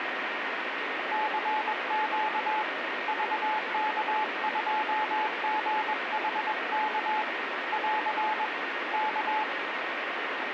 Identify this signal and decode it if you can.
Morse code, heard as a keyed tone, hand-sent with a paddle, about 21 wpm, 860 Hz, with radio static. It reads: CQ VK2GHK <AR> K